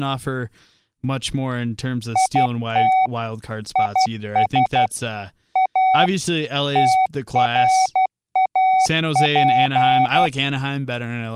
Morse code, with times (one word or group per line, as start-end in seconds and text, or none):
2.2-3.1 IT
3.8-4.9 IS
5.6-6.1 A
6.8-10.3 TRAP